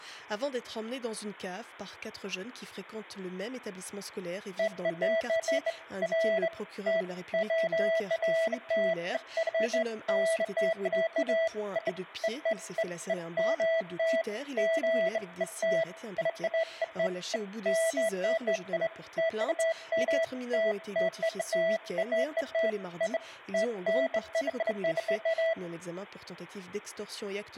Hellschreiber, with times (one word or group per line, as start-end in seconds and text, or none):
none